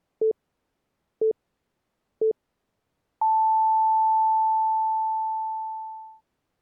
Radio time signal (three low pips and a long one an octave up, as on NHK), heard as pips.